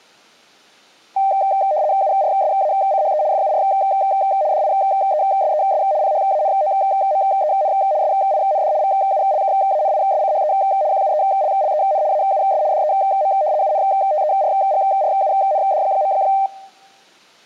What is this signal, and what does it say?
RTTY (75 baud, 170 Hz shift), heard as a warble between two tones, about 690 Hz centre. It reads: URSACHE FUR DIESES PHANOMEN SIND VULKANISCHE QUELLEN AUS DEM UNTERGRUND.